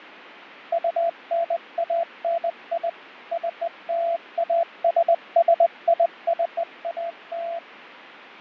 Morse code (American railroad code), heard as a keyed tone, machine-sent, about 680 Hz, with radio static and fading. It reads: UNANI CLASSICAL